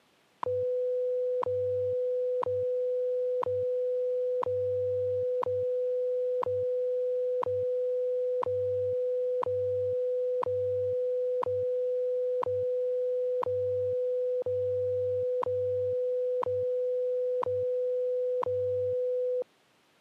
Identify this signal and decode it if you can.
Radio time signal (WWV, Colorado), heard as ticks, one a second.